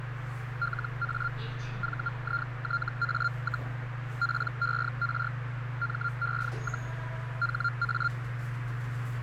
Hellschreiber (Feld-Hell, 122.5 baud), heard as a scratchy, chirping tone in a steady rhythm, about 1390 Hz, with radio static, a narrow filter and the noise inside a lift. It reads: LA VITA, PER ME, HA